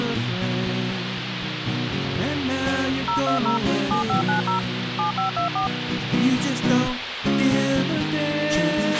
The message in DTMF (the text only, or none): 020 7590 7524